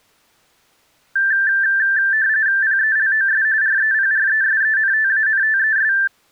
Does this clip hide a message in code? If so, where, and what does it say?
Yes: RTTY (45.45 baud, 170 Hz shift) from 1.2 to 6.1 s, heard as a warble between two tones, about 1650 Hz centre. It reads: PELOS REPRESENTANTES